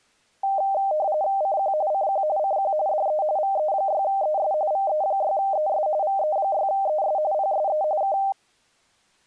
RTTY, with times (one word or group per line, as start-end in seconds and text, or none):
1.4-1.7 CQ
1.9-2.2 CQ
2.4-2.7 CQ
2.9-3.2 DE
3.4-4.5 VE6ES
4.7-5.9 VE6ES
6.0-7.2 VE6ES
7.3-7.8 PSE
8.0-8.2 K